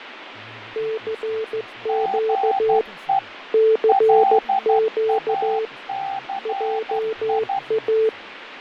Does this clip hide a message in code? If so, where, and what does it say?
Yes: Morse code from 0.7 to 8.1 s, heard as two keyed tones, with radio static, fading and speech in Assamese. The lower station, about 15 wpm, 440 Hz: CQ CQ JA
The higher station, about 12 wpm, 780 Hz: GE LACI